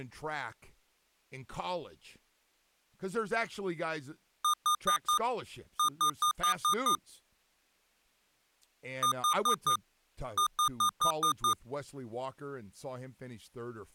Beep code, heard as beeps from a small speaker, played twice, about 1220 Hz, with speech in English. 4-6.